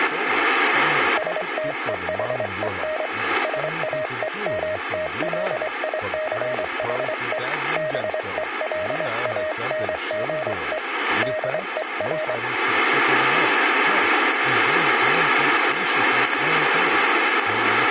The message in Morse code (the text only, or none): STEHEN SAEMTLICHE BELANGE DER